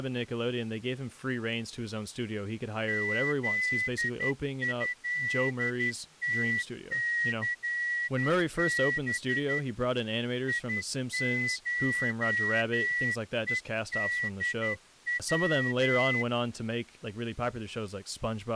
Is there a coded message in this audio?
Yes: Morse code (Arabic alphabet) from 2.8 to 16.3 s, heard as a whistle, hand-sent with a straight key, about 11 wpm, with speech in English. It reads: ذهتثب يشءدو